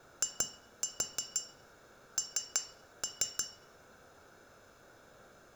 Tap code, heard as taps on glass, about 6 knocks a second, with room echo. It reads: IN